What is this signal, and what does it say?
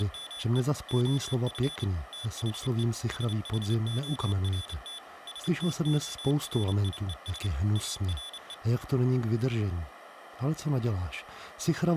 Morse code, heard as a high beeper, machine-sent, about 29 wpm, 3450 Hz, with speech in Czech. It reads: … OF THE SHORT STORIES ARE